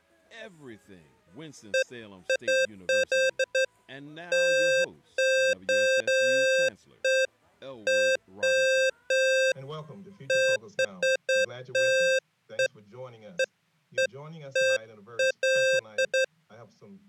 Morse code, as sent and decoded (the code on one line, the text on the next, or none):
none